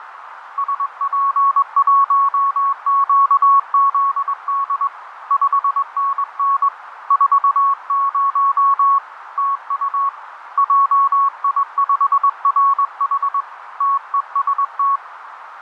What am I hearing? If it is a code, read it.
Morse code, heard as a keyed tone, hand-sent with a straight key, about 21 wpm, 1110 Hz, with radio static and a narrow filter. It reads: SP1QZD 5NN 40 TU JI5RH TEST